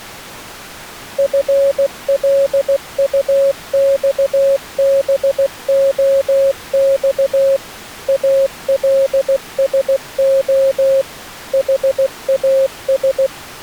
Morse code, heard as a keyed tone, machine-sent, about 16 wpm, 540 Hz. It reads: FLUXBOX ALSO HAS